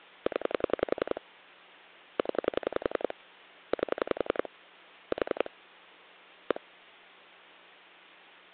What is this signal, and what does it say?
Pulse dialling, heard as clicks on a phone line, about 11 pulses a second. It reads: 0 0 8 4 1